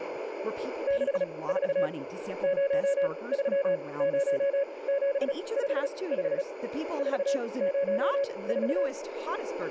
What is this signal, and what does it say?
Morse code, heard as a keyed tone, machine-sent, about 36 wpm, spaced as for 23 wpm, 560 Hz, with radio static, a narrow filter and speech in English. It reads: 64 030755 404